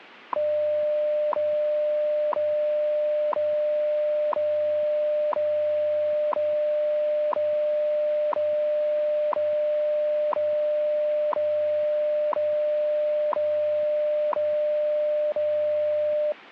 Radio time signal (WWV, Colorado), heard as ticks, one a second.